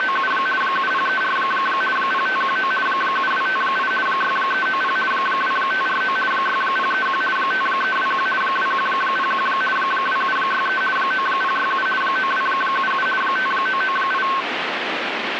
RTTY (50 baud, 450 Hz shift), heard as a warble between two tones, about 1310 Hz centre, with radio static. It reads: … 7034 0519 7258 6390 2549 6031 5321 2101 2763 9067 9277 5998